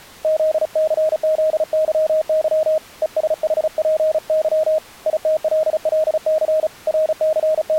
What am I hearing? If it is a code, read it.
Morse code, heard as a keyed tone, hand-sent with a paddle, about 35 wpm, 630 Hz. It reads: ZCZYY ESHPY ITLLC …